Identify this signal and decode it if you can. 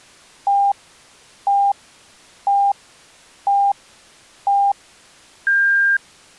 Radio time signal (five pips and a higher one, as on Chinese radio), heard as pips.